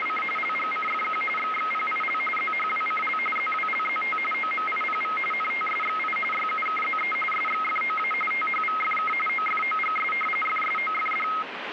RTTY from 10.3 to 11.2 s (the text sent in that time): FSOFD